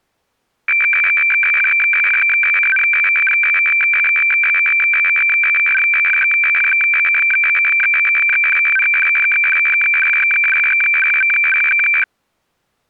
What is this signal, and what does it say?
Weather fax (radiofax), 120 lines a minute, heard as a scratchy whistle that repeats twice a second.